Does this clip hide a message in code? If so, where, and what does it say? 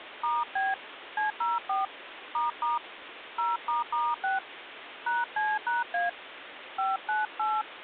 Yes: DTMF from 0.2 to 7.6 s, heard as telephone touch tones, dialled by hand, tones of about 180 ms, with phone line noise. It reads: *B C04 ** 0**6 #C#A 598